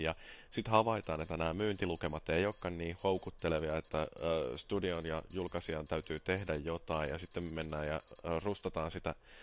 Morse code, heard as a high beeper, hand-sent with a bug key, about 30 wpm, 4000 Hz, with speech in Finnish. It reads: UEEKK USESK MMEMR SRUSR